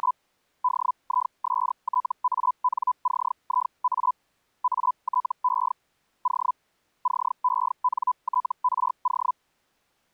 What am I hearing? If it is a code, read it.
Hellschreiber (Feld-Hell, 122.5 baud), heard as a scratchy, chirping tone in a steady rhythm, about 1000 Hz. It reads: … DISTANCIA ATE O CENTRO